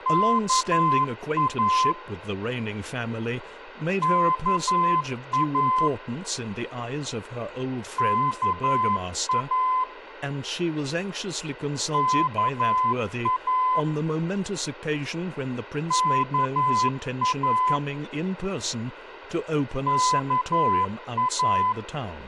Morse code, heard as a keyed tone, machine-sent, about 11 wpm, 1020 Hz, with radio hiss, a squelch burst at the end and speech in English. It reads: KA KA KA KA KA KA